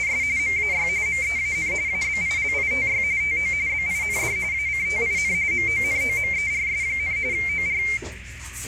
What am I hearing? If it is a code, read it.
RTTY (45.45 baud, 170 Hz shift), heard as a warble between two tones, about 2200 Hz centre, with radio static, a narrow filter and the noise of a restaurant. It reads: … MAY MEAN ABILITY TO BIND ACTIN MONOMERS, OR